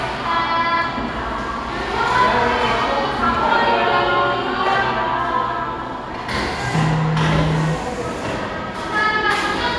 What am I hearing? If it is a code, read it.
The noise of a cafe. There is no code.